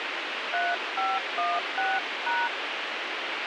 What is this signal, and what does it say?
DTMF, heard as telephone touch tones, dialled by hand, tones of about 210 ms, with radio hiss. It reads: 3516#